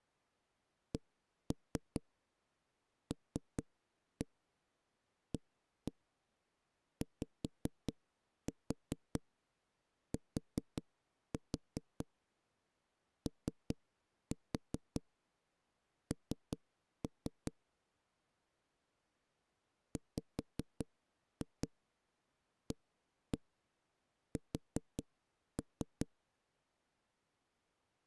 Tap code, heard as knocks on a wall, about 5 knocks a second. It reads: CLAYTON WAS